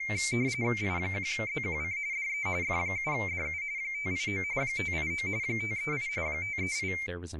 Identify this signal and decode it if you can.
RTTY (45.45 baud, 170 Hz shift), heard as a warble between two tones, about 2200 Hz centre, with speech in English. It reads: I1ZQC DE F7DU 589 589 538 538